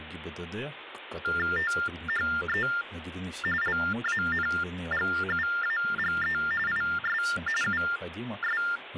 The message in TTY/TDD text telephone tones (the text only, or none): THE LANGUAGE IS …